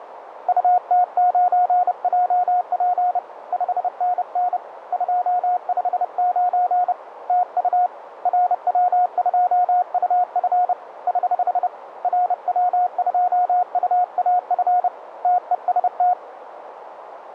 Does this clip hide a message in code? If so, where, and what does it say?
Yes: Morse code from 0.4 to 16.2 s, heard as a keyed tone, hand-sent with a paddle, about 30 wpm, 720 Hz, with radio static and a narrow filter. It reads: UT9JP 5NN 259 TU RW2UF <HH> RW2UAF TEST